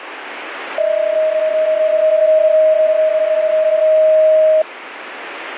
PSK31 (31.25 baud), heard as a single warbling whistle, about 630 Hz, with radio static.